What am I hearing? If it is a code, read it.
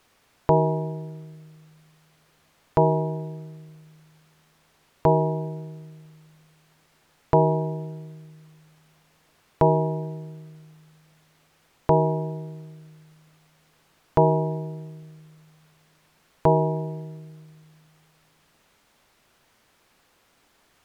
Clock strike, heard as a bell. 8. Eight o'clock.